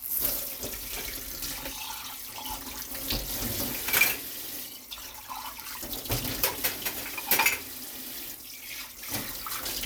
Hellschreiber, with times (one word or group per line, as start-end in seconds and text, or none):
none